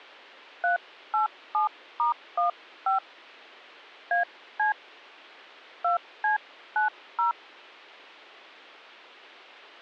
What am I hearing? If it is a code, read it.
DTMF, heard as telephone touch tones, dialled by hand, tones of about 130 ms. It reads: 387*15 AC 2C90